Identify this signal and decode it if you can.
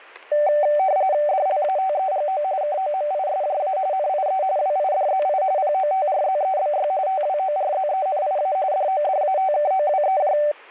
RTTY (45.45 baud, 170 Hz shift), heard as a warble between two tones, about 680 Hz centre, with static crashes. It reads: DLATEGO KOMISJA NIE WIDZI POTRZEBY TWORZENIA DODATKOWEJ